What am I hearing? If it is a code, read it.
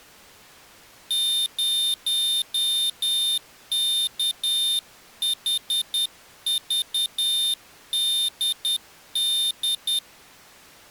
Morse code, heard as a high beeper, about 10 wpm, 3600 Hz. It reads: 0KHVDD